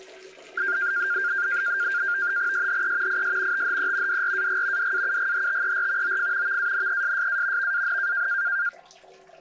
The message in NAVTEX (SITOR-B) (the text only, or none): SHE IS THE DRAG DAUGHTER OF VANESSA VAN